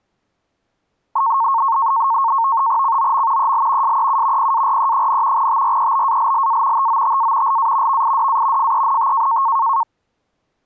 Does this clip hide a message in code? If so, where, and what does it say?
Yes: NAVTEX (SITOR-B), 100 baud, 170 Hz shift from 1.2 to 9.8 s, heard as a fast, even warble, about 1000 Hz centre. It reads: COM EL SEU PARE, TREBALLA TOTA LA VIDA FENT